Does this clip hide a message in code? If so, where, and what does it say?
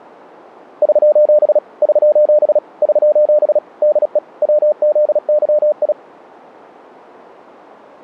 Yes: Morse code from 0.8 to 6.0 s, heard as a keyed tone, machine-sent, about 36 wpm, 600 Hz. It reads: <SOS> <SOS> <SOS> DE WZYI